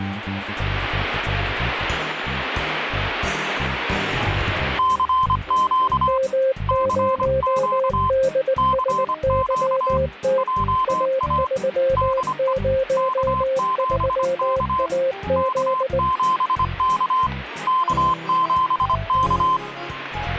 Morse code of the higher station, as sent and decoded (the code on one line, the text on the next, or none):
-.-. --.- / -.-. --.- / -.-. --.- / .--- .- / -.. . / -.- --... -.- / -.- --... -.- / -.- --... -.-
CQ CQ CQ JA DE K7K K7K K7K